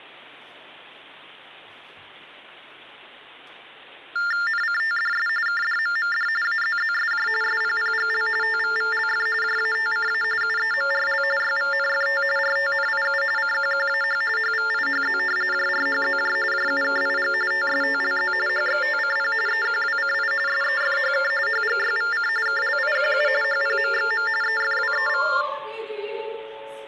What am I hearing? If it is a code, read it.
TTY/TDD text telephone tones (45.45 baud Baudot), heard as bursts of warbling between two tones, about 400 Hz shift, 1600 Hz centre. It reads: NCTDS KDMMD AZZSJ SPPGL TVVLF JATCA UEMRL YVNFT RTNIU CQQAH HVIHZ JRHZJ JUKIG TSTLZ HXTCP EQWCI SEFHK HGYVC KLIQU HPMXM EFWEV